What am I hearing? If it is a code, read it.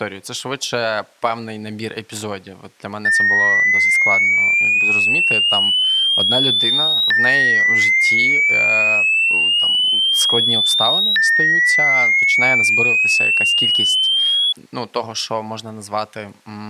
A tone that sweeps in pitch again and again, with speech in Russian. There is no code.